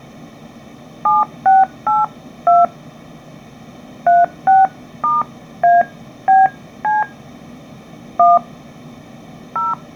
DTMF, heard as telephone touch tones, dialled by hand, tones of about 180 ms. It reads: 7682 36*ABC 1 0